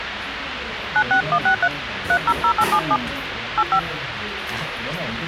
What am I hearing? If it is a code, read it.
DTMF, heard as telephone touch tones, dialled by hand, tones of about 80 ms, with radio hiss and the noise of a restaurant. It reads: 96163 300877 85